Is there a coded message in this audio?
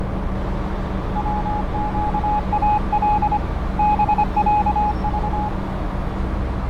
Yes: Morse code (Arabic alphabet) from 1.1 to 5.5 s, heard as a keyed tone, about 25 wpm, 840 Hz, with radio static, fading, a narrow filter and street noise. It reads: وقال بعض